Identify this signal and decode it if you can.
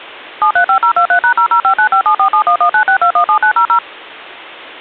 DTMF, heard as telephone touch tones, dialled by machine, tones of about 90 ms. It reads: 735023#005957471196217900